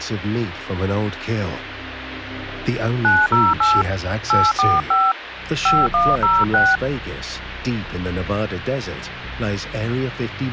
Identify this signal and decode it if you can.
DTMF, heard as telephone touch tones, dialled by hand, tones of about 210 ms, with phone line noise. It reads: 908 845 5106